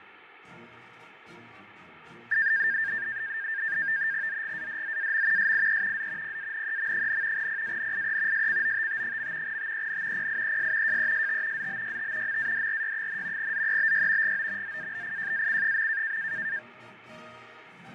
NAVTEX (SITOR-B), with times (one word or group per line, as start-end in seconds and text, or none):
4.3-5.5 ZGADZAM
5.4-6.1 SIE
6.0-6.4 Z
6.2-7.5 PANEM,
7.4-8.5 PANIE
8.3-9.6 SCOTT.
9.5-10.3 TEN
10.2-11.0 PIES
10.9-11.7 JEST
11.6-12.4 ZBYT
12.3-13.5 MADRY,
13.4-14.4 ZEBY
14.2-14.8 GO
14.6-16.2 ZABIJAC.